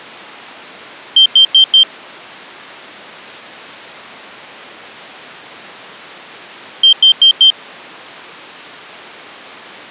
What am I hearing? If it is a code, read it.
Alarm pattern, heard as an alarm's beeps, played twice, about 3150 Hz. Temporal four. Carbon monoxide.